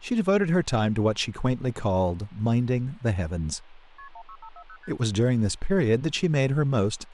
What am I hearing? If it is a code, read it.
Multi-frequency trunk signalling (R1, as on North American trunks), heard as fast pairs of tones, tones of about 70 ms, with phone line noise and speech in English. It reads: KP 16540 ST